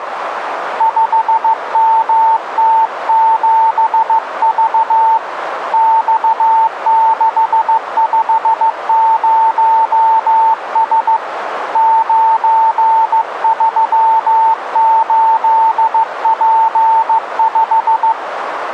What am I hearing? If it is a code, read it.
Morse code, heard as a keyed tone, hand-sent with a paddle, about 15 wpm, 900 Hz, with radio static and a narrow filter. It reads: 5MT7V X650S 938P5